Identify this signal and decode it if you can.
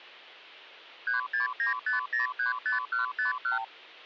Multi-frequency trunk signalling (R2, with the far end's replies), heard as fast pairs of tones, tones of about 130 ms, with hum. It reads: 3695035151